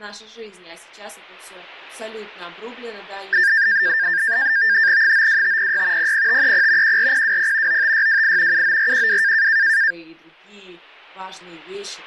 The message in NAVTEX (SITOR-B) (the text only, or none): 92506 00530 14020 95628 79412